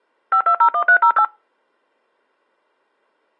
DTMF, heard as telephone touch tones, dialled by machine, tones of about 80 ms. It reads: 5201308